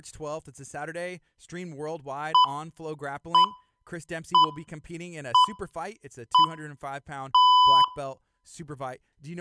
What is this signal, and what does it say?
Radio time signal (six pips, as the Greenwich Time Signal), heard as pips, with room echo and speech in English.